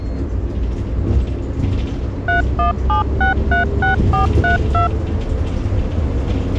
DTMF, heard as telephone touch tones, dialled by machine, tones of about 130 ms, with the noise inside a bus. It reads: 317636432